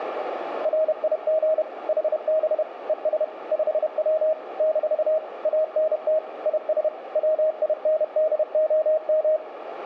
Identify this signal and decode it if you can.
Morse code, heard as a keyed tone, machine-sent, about 31 wpm, 630 Hz, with radio static and a narrow filter. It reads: RIG HB ES 5W - ANT IS WINDOM